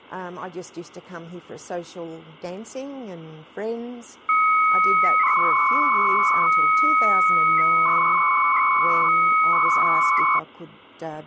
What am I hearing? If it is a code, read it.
300-baud modem data (Bell 103 tones), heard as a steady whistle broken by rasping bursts, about 300 baud, 200 Hz shift.